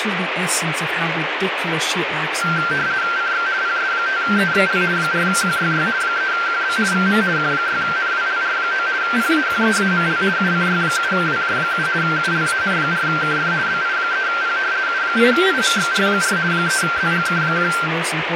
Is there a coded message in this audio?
Yes: RTTY (50 baud, 170 Hz shift) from 2.4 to 17.9 s, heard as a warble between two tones, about 1470 Hz centre, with radio static and speech in English. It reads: CX PS5EXL 4QYY 3QB VM Q6NWLR9 PAQEAML UCY7WJ7 ULAN4KF BI3P U8IMXR4 3ZGK1